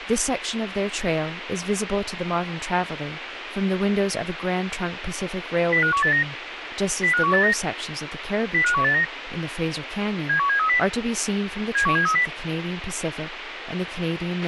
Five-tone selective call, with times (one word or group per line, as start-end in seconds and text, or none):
5.7-6.2 05189
7.0-7.5 05189
8.5-9.0 05189
10.3-10.8 71730
11.8-12.3 71730